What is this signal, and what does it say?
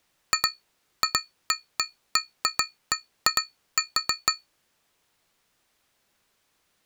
Irregular taps on glass. There is no code.